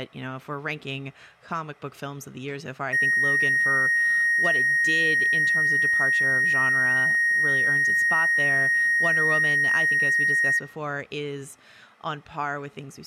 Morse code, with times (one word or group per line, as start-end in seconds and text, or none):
none